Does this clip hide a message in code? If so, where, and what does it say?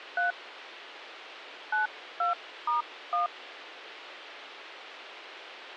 Yes: DTMF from 0.2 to 3.3 s, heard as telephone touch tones, dialled by hand, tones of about 140 ms, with radio hiss. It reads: 3 92*1